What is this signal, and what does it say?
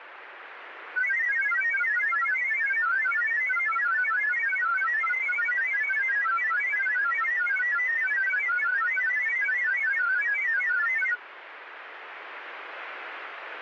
Multi-tone FSK (Olivia or MFSK type), about 1000 Hz wide, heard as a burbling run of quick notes, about 31.25 baud, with radio static.